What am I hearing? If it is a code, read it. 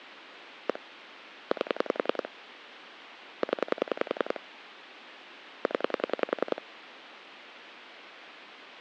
Pulse dialling, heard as clicks on a phone line, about 10 pulses a second, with phone line noise. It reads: 1 8 0 0